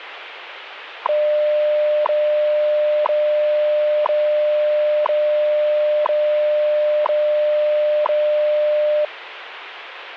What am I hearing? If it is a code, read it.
Radio time signal (WWV, Colorado), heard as ticks, one a second, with radio static.